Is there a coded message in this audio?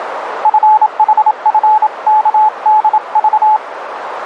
Yes: Morse code (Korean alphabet) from 0.4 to 3.6 s, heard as a keyed tone, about 27 wpm, 860 Hz, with radio static and a narrow filter. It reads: 눈을